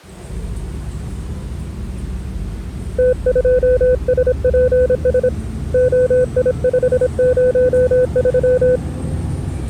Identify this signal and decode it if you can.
Morse code, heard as a keyed tone, hand-sent with a paddle, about 26 wpm, 500 Hz, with the noise inside a bus. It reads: T2SPS OI503